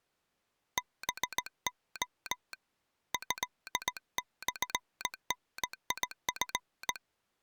Morse code (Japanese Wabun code), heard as a telegraph sounder, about 18 wpm. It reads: ハレ トモダチ